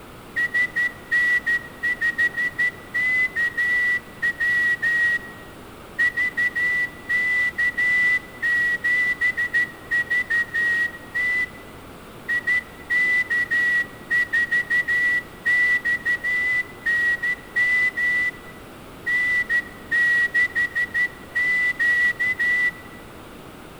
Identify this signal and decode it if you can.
Morse code, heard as a whistle, hand-sent with a straight key, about 13 wpm, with room echo. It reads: SN5KW VK7VT IK4XNM N6Q